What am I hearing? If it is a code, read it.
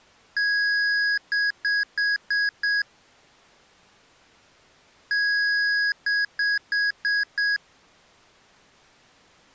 Beep code, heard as beeps from a small speaker, played twice, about 1650 Hz. 1 long, 5 short.